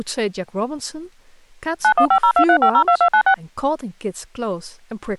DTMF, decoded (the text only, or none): 915023502296